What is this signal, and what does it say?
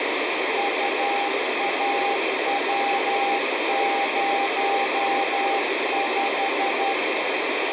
Morse code, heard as a keyed tone, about 12 wpm, 800 Hz, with heavy radio static. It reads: UAW05